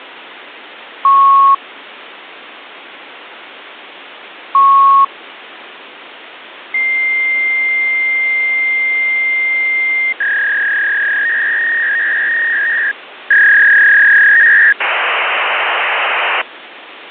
Fax machine handshake, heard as beeps, a long tone, a warble and hiss, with phone line noise.